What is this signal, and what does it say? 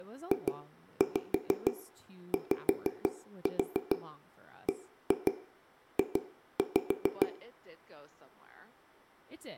Tap code, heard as taps on a table, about 6 knocks a second, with room echo and speech in English. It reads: JYBJ